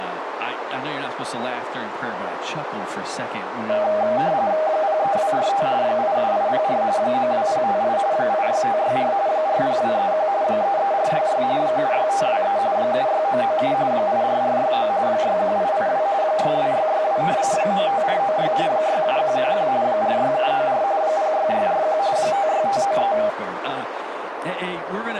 RTTY (45.45 baud, 170 Hz shift), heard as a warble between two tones, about 710 Hz centre, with radio static and a narrow filter. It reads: 03245 87804 92058 86564 40231 33466 76523 76997 84469 61882 62662 95496 67111 46794 06641 56593